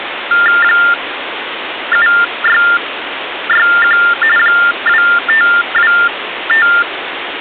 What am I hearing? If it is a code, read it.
TTY/TDD text telephone tones (45.45 baud Baudot), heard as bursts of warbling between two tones, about 400 Hz shift, 1600 Hz centre, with phone line noise. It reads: 7661 2525